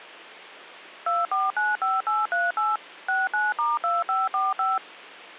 DTMF, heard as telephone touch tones, dialled by machine, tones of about 190 ms. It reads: 2495838 69*2545